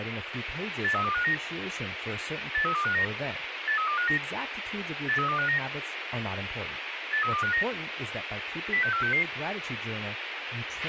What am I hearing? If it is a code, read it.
Five-tone selective call (CCIR), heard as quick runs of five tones, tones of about 100 ms, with radio hiss, a squelch burst at the end and speech in English. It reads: 83259 83259 83259 83259 83259 06466